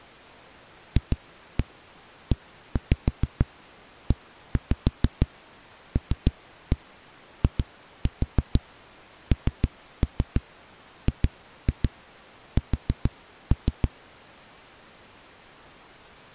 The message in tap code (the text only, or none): FEELINGS